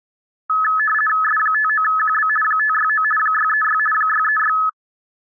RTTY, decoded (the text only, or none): S59QB 569 636 636